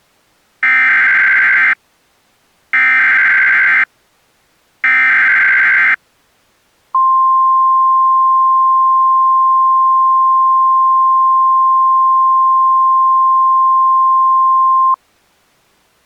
Emergency Alert System (SAME) tones (header bursts, then the 1050 Hz attention tone), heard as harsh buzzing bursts, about 520.83 baud.